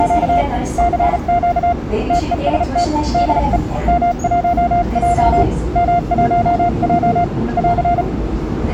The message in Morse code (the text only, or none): … CQ TEST DE M1J M1J <AR>